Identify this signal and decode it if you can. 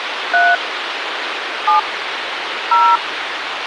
DTMF, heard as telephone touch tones, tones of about 220 ms, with radio hiss. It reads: 3 7 0